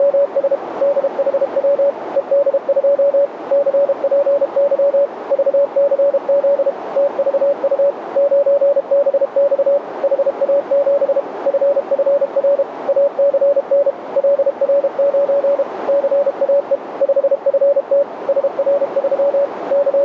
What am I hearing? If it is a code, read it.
Morse code, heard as a keyed tone, machine-sent, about 32 wpm, 570 Hz, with radio static and a narrow filter. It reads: … DHW ED2 CPY VCZ TVU 9BX HA7 FFR ACN LR9 CAE 5FT SR3 …